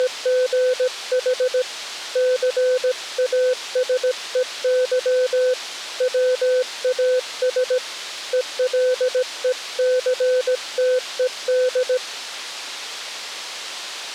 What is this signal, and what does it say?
Morse code, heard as a keyed tone, hand-sent with a paddle, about 17 wpm, 510 Hz. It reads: … CASEY WAS ELECTED